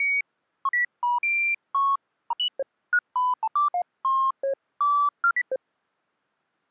Electronic bleeps of random pitch and length. There is no code.